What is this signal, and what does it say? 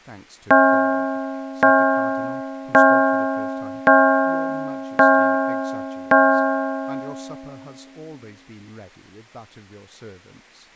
Clock strike, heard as a bell, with speech in English. 6. Six o'clock.